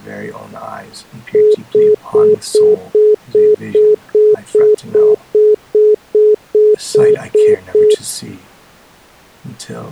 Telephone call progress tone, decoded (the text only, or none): congestion tone